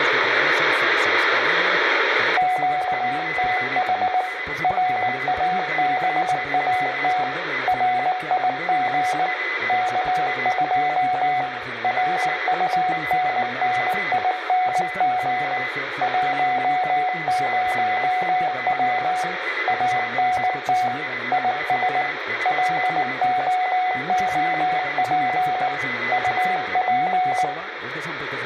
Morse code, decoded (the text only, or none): QTH RABAT RIG K2 RUNNING 10W ANT IS LOOP UP